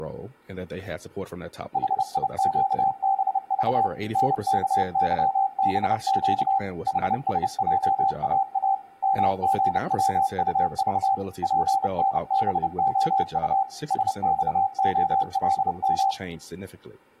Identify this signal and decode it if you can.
Morse code, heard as a keyed tone, machine-sent, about 30 wpm, 780 Hz, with room echo and speech in English. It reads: HIQBV NKYBQ HSJAA MGWUV PNBOU SXOLM